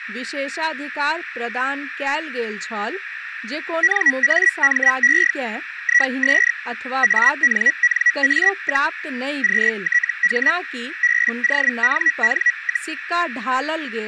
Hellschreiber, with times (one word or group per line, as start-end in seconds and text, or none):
3.8-5.3 NAME
5.8-6.5 IS
7.0-8.9 ANNA,
9.4-10.5 QTH
11.0-12.9 BONN,